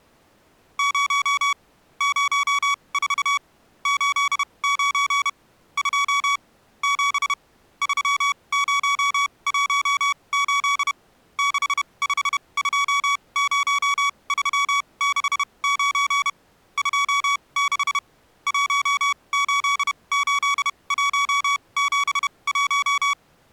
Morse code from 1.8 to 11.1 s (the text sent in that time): 04 89 2 7 3018